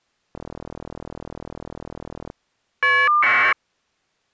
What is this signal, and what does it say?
Caller ID data burst, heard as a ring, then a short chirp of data, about 1200 baud.